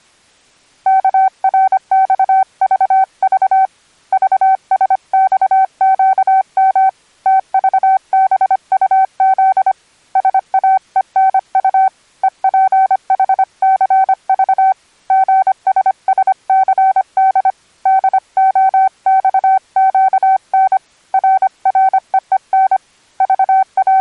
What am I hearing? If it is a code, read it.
Morse code, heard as a keyed tone, hand-sent with a paddle, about 25 wpm, 770 Hz. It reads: KRXVV VSXQM TVBUZ SAENU EPHCV GSSCD DOXQN RREEN …